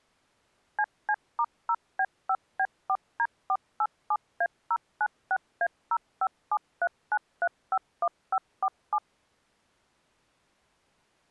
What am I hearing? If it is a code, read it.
DTMF, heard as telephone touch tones, dialled by machine, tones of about 60 ms. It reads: CC*0B5B4D487A096A05739351547